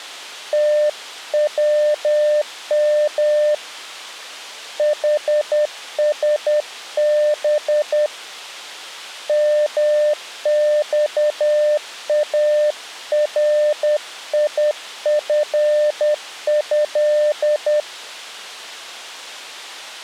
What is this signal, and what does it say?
Morse code (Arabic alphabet), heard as a keyed tone, hand-sent with a paddle, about 10 wpm, 600 Hz. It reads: توم حسب مصاريفه